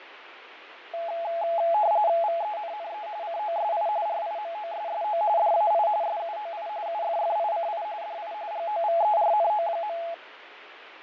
RTTY (45.45 baud, 170 Hz shift), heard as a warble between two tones, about 760 Hz centre, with radio static and fading. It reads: VENNE COSI RIMOSSO DAI SUOI UFFICI DI GOVERNO.